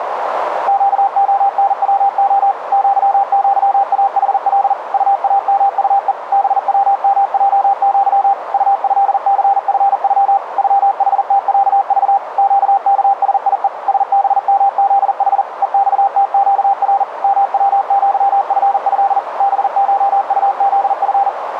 Morse code (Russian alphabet), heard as a keyed tone, machine-sent, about 40 wpm, 790 Hz, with radio static and a narrow filter. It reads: ЩОНВО ЪЪАХЛ УАМУЕ БВМЙЪ УЭЦФЮ ЮХТЯЖ ЩКСИЕ СБМЗХ ЕЬТЩР МВЪФЭ БШУЗФ